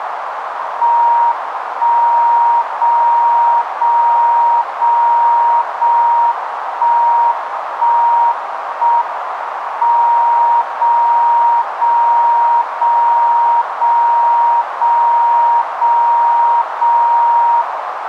Radio time signal (JJY), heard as a tone whose level steps once a second, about 940 Hz, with radio static and a narrow filter. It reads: 1 0 0 0 0 1 1 1 M 0 0 0 0 0 0 0 0